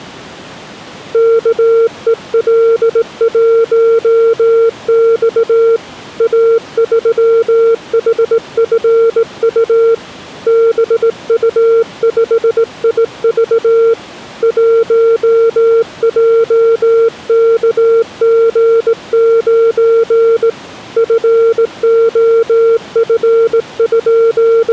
Morse code, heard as a keyed tone, hand-sent with a straight key, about 18 wpm, 460 Hz. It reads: KEL1X A3HFU BU5IV 1JKG9 …